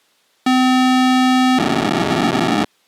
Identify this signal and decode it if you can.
POCSAG pager data (512 baud), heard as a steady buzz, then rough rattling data.